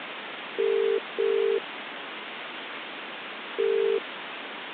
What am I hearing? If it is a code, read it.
Telephone call progress tone (as in the UK, Ireland, Australia and similar networks), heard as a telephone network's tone, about 400, 450 Hz, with phone line noise. Ringback tone.